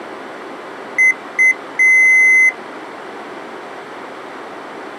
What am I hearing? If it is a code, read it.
Beep code, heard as beeps from a small speaker, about 2050 Hz. 2 short, 1 long.